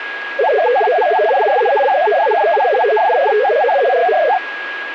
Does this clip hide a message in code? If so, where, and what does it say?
Yes: multi-tone FSK (Olivia or MFSK type), about 500 Hz wide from 0.4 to 4.4 s, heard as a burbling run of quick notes, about 62.5 baud, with radio static and a steady whistle near 1650 Hz.